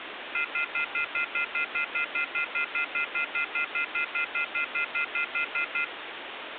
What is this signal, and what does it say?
Telephone call progress tone (North American plan), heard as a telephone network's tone, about 1400, 2050, 2450, 2600 Hz, 0.1 s on and 0.1 s off, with phone line noise. Off-hook warning tone.